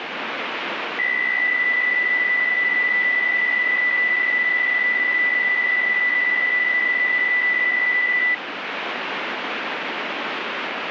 PSK63 (62.5 baud), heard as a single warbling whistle, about 2000 Hz, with radio static.